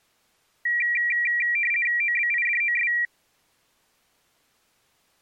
RTTY (50 baud, 450 Hz shift), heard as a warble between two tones, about 2150 Hz centre. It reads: OBIDOS